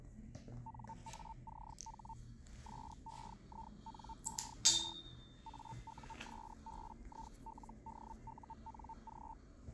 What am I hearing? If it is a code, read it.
Hellschreiber (Feld-Hell, 122.5 baud), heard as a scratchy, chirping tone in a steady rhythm, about 900 Hz, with the noise inside a lift. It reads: NACH SEINER AUSBILDUNG